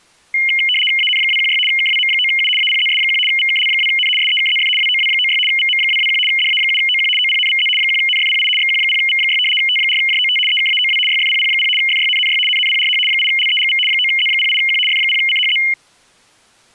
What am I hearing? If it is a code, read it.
RTTY (75 baud, 850 Hz shift), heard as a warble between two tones, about 2550 Hz centre. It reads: AN216 KWM9U APZS1 VKL2N SEKZF WOW96 VM221 DA7OQ OPNVZ 1NFPI XQ0V6 T4JOT EKAOW YFPP0 FYNNY NNPRH 8LEGV 9Z08Q F0CHZ